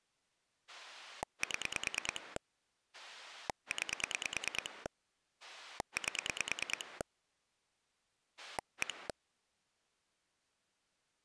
Pulse dialling, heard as a rotary dial, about 9 pulses a second. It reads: 7 9 8 1